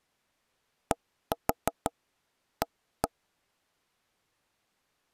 Tap code, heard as taps on a table, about 6 knocks a second. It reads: DA